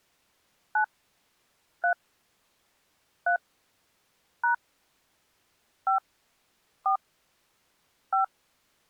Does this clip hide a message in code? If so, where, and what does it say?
Yes: DTMF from 0.8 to 8.2 s, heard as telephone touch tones, dialled by hand, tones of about 120 ms. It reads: 9 3 3 # 5 4 5